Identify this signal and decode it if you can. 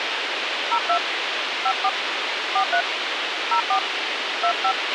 DTMF, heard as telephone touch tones, dialled by hand, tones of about 70 ms, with radio hiss and a squelch burst at the end. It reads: 02 54 43 04 25